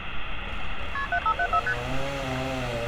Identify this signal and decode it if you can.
Multi-frequency trunk signalling (R1, as on North American trunks), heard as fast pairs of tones, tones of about 70 ms, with phone line noise and street noise. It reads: KP 7574 ST